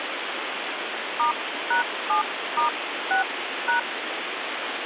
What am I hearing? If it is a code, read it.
DTMF, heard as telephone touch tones, dialled by hand, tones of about 120 ms, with phone line noise. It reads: *#7*6#